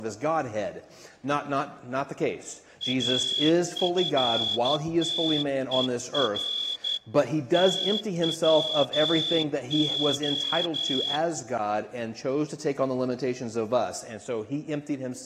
Morse code, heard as a whistle, hand-sent with a straight key, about 12 wpm, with room echo. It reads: AFTER TWO